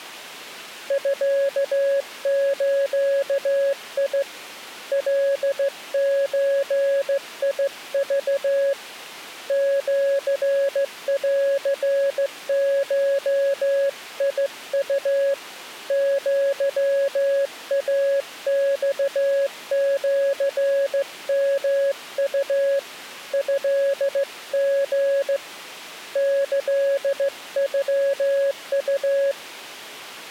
Morse code (Japanese Wabun code), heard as a keyed tone, hand-sent with a straight key, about 15 wpm, 550 Hz. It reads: ミズ カゾク シンゴウ アイマシヨウ トリ キノウ